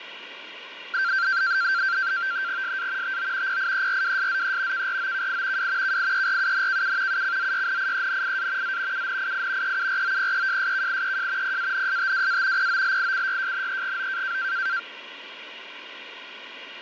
NAVTEX (SITOR-B), 100 baud, 170 Hz shift, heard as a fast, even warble, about 1470 Hz centre, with radio static. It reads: SA TO PIERWSZE KROKI W KIERUNKU UCZYNIENIA Z UNII EUROPEJSKIEJ PANSTWA POLICYJNEGO